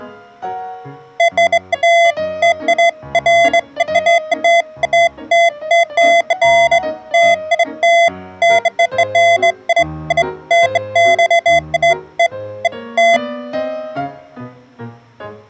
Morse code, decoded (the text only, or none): none